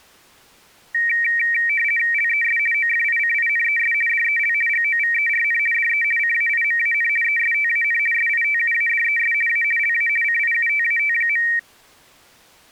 RTTY (50 baud, 450 Hz shift), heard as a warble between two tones, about 2100 Hz centre. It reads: LES OFICINES DEL GOVERN DE CAIMAN ESTAN SITUADES A LA CIUTAT.